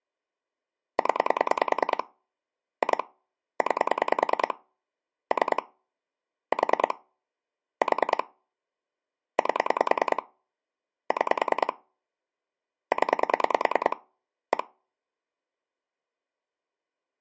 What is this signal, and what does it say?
Pulse dialling, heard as clicks on a phone line, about 10 pulses a second. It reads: 0 2 9 3 4 4 8 6 0 1